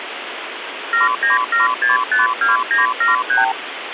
Multi-frequency trunk signalling (R2, with the far end's replies), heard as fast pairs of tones, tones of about 150 ms, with phone line noise. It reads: 797652973